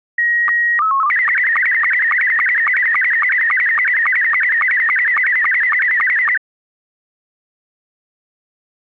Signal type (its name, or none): SSTV (slow-scan television)